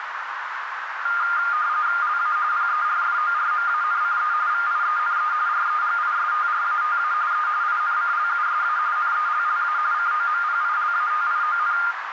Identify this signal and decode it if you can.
RTTY (45.45 baud, 170 Hz shift), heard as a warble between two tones, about 1310 Hz centre, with radio static and a narrow filter. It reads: LA PERFORMANCE VIENE REGISTRATA E INCLUSA NELLA COMPILATION